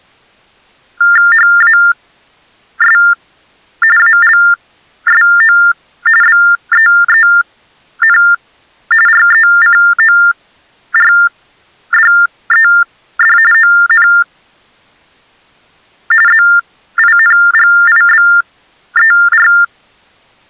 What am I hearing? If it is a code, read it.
TTY/TDD text telephone tones (45.45 baud Baudot), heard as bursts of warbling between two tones, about 400 Hz shift, 1600 Hz centre. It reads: HAS ALSO BEEN RECORDED ON ZINGIBER